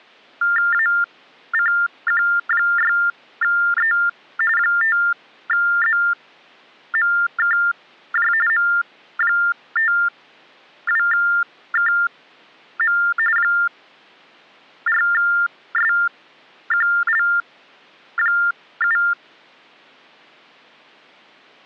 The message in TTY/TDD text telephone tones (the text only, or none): ACQ6E 5ZMKJ M52KM 4SQL7